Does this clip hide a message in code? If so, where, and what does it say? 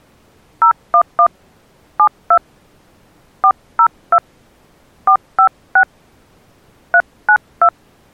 Yes: DTMF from 0.6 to 7.7 s, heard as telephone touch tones, dialled by hand, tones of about 80 ms. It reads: 011 72 402 456 392